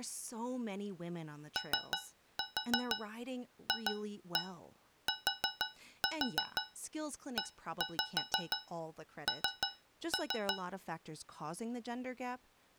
Tap code, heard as taps on a metal pipe, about 6 knocks a second, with speech in English. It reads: OFTEN